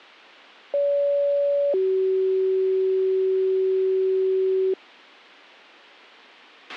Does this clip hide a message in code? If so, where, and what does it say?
Yes: two-tone page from 0.7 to 4.7 s, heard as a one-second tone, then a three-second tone, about 570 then 380 Hz, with a squelch burst at the end.